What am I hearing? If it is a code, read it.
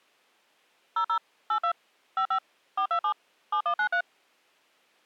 DTMF, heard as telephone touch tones, dialled by machine, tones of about 80 ms. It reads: 00 82 55 427 7193